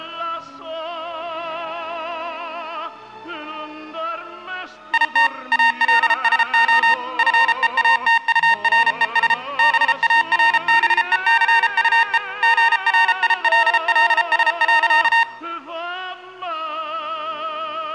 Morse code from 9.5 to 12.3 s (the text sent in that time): BARBECUE